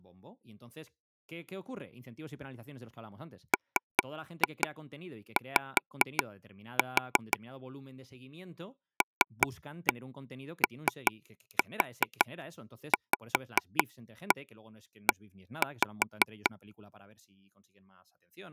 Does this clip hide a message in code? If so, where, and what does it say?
Yes: tap code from 3.5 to 16.5 s, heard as taps on a table, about 5 knocks a second, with speech in Spanish. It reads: MY LOVE